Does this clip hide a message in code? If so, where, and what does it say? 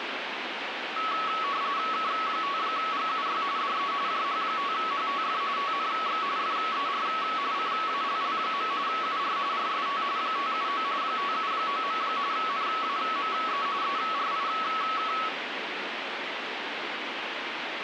Yes: RTTY (45.45 baud, 170 Hz shift) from 1.0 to 15.3 s, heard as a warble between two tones, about 1210 Hz centre, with radio static. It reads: K5GUY DE JH5HTF TNX FER CALL. UR RST 579 579. NAME ERIK